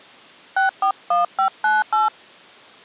DTMF, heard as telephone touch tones, dialled by hand, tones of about 150 ms. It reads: 641598